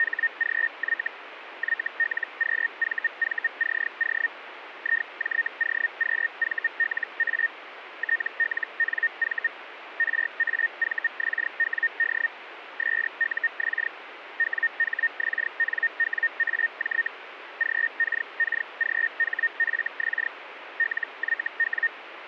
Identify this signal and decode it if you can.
Hellschreiber (Feld-Hell, 122.5 baud), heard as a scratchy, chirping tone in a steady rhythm, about 1850 Hz, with radio static. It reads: … YLQVVCO IJOQVLA TLNV RAVXWD SUX WHXNWAJ GKKGHFX LYW